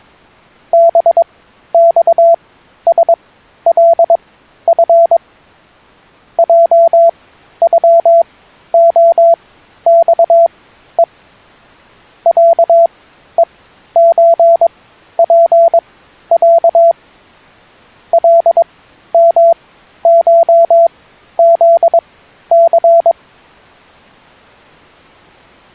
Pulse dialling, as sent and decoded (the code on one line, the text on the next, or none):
none